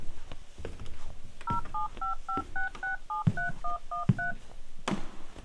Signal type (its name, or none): DTMF